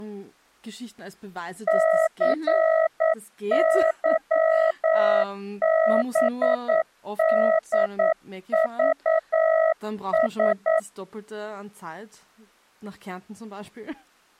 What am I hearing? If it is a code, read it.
Morse code (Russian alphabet), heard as a keyed tone, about 9 wpm, 640 Hz, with speech in German. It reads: ЦЫБДЖС